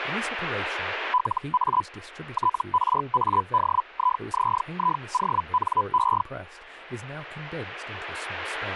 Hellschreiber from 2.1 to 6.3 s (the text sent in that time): TRADIZIONE